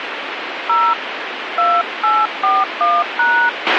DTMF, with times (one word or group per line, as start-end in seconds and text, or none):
0.7-0.9 0
1.6-3.5 2841#